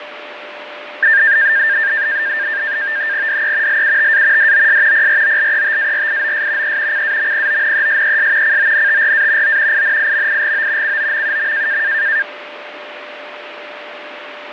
NAVTEX (SITOR-B), 100 baud, 170 Hz shift, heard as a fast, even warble, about 1700 Hz centre, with radio static, fading and a steady whistle near 590 Hz. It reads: DE LUTA DOS PROLETARIOS E CAMPONESES CONTRA O INIMIGO COMUM